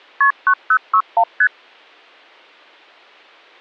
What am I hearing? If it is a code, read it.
Multi-frequency trunk signalling (R1, as on North American trunks), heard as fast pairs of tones, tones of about 70 ms. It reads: KP 9061 ST